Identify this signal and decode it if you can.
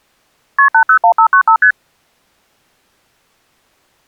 Multi-frequency trunk signalling (R1, as on North American trunks), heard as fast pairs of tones, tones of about 90 ms. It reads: KP 801595 ST